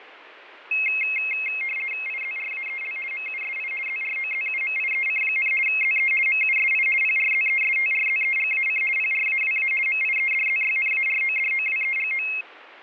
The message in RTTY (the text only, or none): IZRAEL MUSI ZROZUMIEC, ZE MUSI PRZESTRZEGAC PRAWA MIEDZYNARODOWEGO